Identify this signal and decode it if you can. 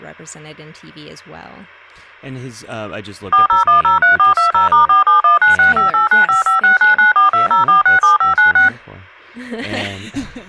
DTMF, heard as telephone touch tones, dialled by machine, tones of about 130 ms, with speech in English. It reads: 40103420*4719658955699420467596